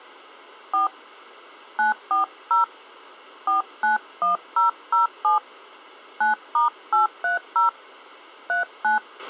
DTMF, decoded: 4 940 491007 9*830 39

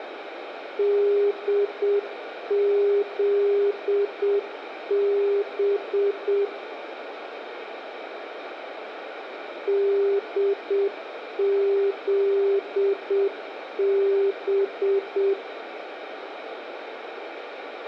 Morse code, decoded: DZB DZB

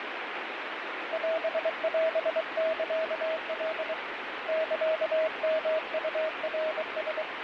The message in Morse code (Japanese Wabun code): オオサカ サヨウナラ

